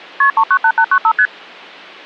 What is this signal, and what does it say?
Multi-frequency trunk signalling (R1, as on North American trunks), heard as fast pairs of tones, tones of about 70 ms. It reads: KP 398895 ST